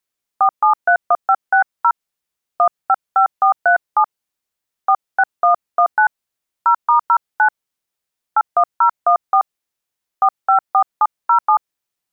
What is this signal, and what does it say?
DTMF, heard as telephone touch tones, dialled by hand, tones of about 80 ms. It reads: 4731560 155437 46119 0*09 81014 454707